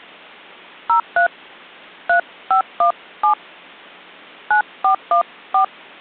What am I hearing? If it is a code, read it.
DTMF, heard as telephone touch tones, dialled by hand, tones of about 100 ms. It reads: 03 3517 9414